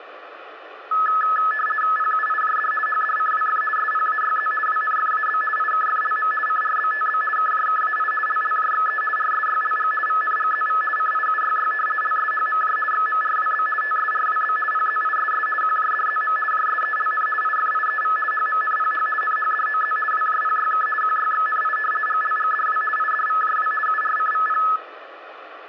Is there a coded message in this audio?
Yes: RTTY (50 baud, 450 Hz shift) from 0.9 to 24.8 s, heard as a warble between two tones, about 1500 Hz centre, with radio static and room echo. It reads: PUIJD HDCWF SPAYZ WNFAB IKFLM CRBTB KJKAI LLJXE RSYLG VNGZV CIUYY LSHMJ XMRWB TSRWB PZISS QJDZM JSELN IFIEV HMNPH NHDOZ WJPYK QYXNI GLGDW IDVJW URCVP